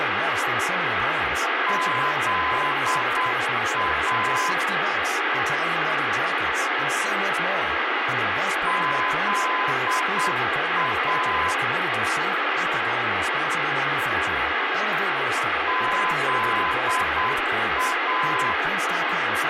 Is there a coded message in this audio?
Yes: Morse code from 1.6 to 18.6 s, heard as a keyed tone, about 8 wpm, 1020 Hz, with radio hiss, room echo and speech in English. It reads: ZA ZA ZA